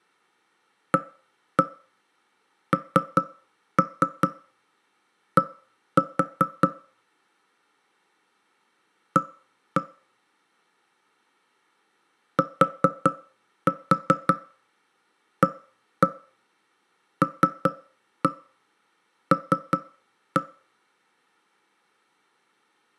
Tap code, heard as knocks on wood, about 5 knocks a second, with room echo. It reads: AND A TALL